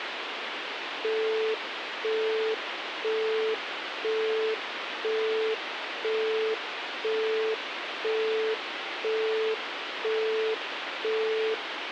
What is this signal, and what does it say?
Telephone call progress tone (single-tone plan, as in Europe, Japan and elsewhere), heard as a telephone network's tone, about 440 Hz, 0.5 s on and 0.5 s off, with phone line noise. Busy tone.